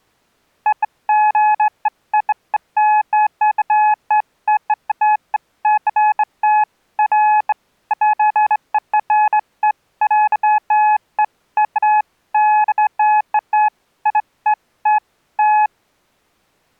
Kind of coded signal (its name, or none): none